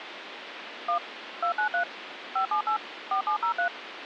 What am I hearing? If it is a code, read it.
DTMF, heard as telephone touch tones, dialled by machine, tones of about 100 ms, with phone line noise. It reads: 1 293 578 4703